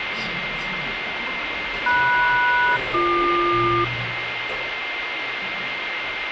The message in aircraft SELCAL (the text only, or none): MS-BQ